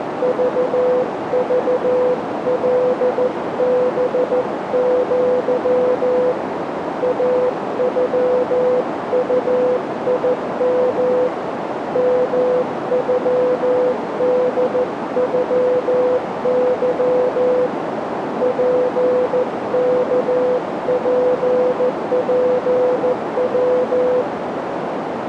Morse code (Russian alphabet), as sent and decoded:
...- ...- .-.. -... --.-- / .- ..-- ..- .. -- / -- ..-- -.. ..-- -.-- / .--. -.- .--. .--. .--
ЖЖЛБЪ АЮУИМ МЮДЮЫ ПКППВ

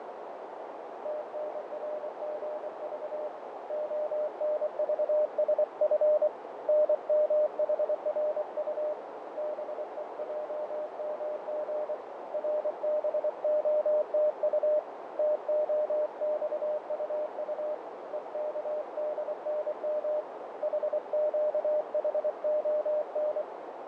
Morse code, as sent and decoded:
- -. .-. --. ...- / --- -. ...- ... ..-. / -. -- .... .-. ..- / -... . .--- -- --. / .-. -... --- - ..- / - --- -..- ..- ..- / . -.- -.. -. -- / .... --.- .... --- -.
TNRGV ONVSF NMHRU BEJMG RBOTU TOXUU EKDNM HQHON

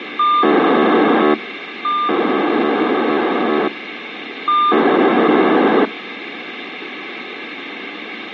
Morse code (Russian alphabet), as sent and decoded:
none

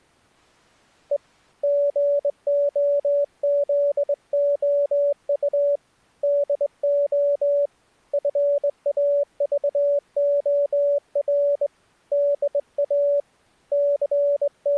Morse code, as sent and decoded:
. / --. --- --.. --- ..- / -.. --- / ..-. .- ...- --- .-. / -.. .- / …
E GOZOU DO FAVOR DA …

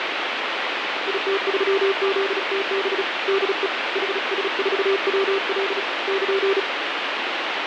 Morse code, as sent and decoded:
.. - ...-- --.. - -... / -.. . / .... ... ....- .-- .-.. / -.--.
IT3ZTB DE HS4WL <KN>

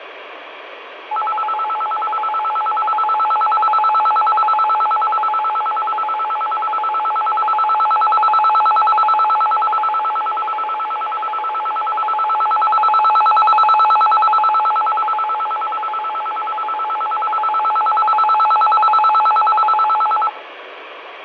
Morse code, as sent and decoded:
none

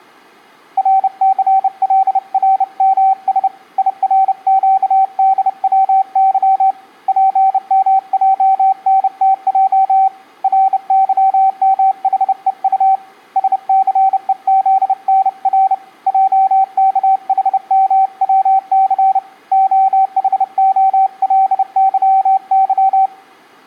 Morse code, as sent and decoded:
.-. -.-. .-.. .-. -- ... / .. .-. --.- -.. .-- -.-- / .--. -- .--- -. - .--- / .-. -.-- -- .... . ..- / ... -.-. . --.. -. .-. / .--- -.- .... -- .-- -.-. / --- .... --- .-.. -.-- -.--
RCLRMS IRQDWY PMJNTJ RYMHEU SCEZNR JKHMWC OHOLYY

